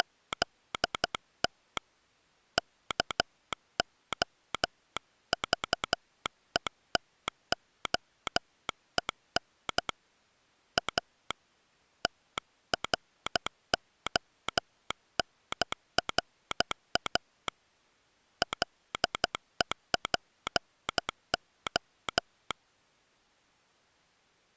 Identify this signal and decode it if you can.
Morse code, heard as a telegraph sounder, hand-sent with a paddle, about 12 wpm. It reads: … KOVETOEN A TRONRA LEPO